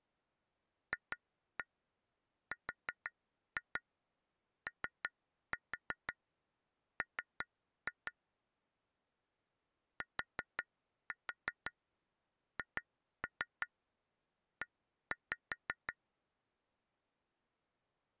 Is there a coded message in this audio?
Yes: tap code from 0.9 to 16.0 s, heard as taps on glass, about 5 knocks a second. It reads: FROM THE